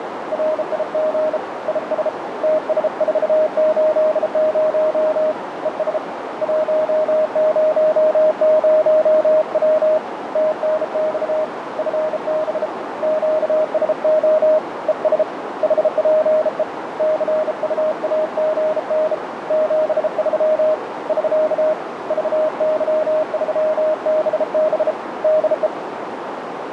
Morse code, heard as a keyed tone, hand-sent with a bug key, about 33 wpm, 620 Hz, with radio static and a narrow filter. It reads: RIG IS TS480 ES 100W TNX FB QSO ES HPE CUAGN 73 <SK> VY3BB DE